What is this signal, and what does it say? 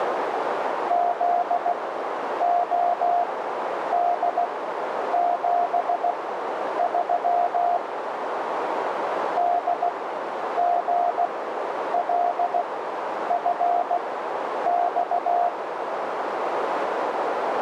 Morse code, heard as a keyed tone, machine-sent, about 16 wpm, spaced as for 9 wpm, 700 Hz, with radio static and a narrow filter. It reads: ZOD73 DGLFX